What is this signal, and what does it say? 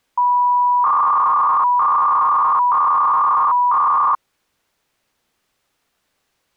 300-baud modem data (V.21 tones), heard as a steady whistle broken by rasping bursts, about 300 baud, 200 Hz shift.